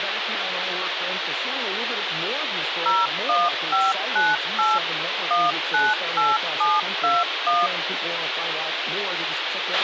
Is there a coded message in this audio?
Yes: DTMF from 2.9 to 7.7 s, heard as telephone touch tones, dialled by machine, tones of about 200 ms, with radio hiss, a squelch burst at the end and speech in English. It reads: 01598 198721